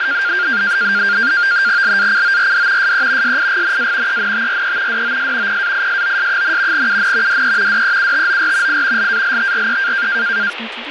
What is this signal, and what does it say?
NAVTEX (SITOR-B), 100 baud, 170 Hz shift, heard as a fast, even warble, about 1500 Hz centre, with radio static and speech in English. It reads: LACORD SE SIGNA ENTRE DOS PAISOS, UN DE DEUTOR I LALTRE